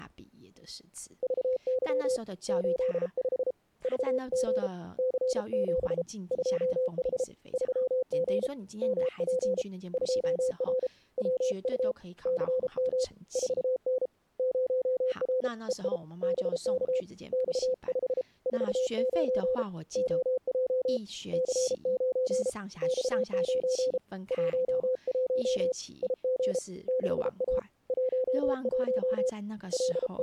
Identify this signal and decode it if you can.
Morse code, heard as a keyed tone, hand-sent with a paddle, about 33 wpm, 510 Hz, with speech in Chinese. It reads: VY 85 VG C7 2H 3G MP 2R WU CM 4N 0R EI BK X5 49 OJ C9 X9 11 IG 6A 11 …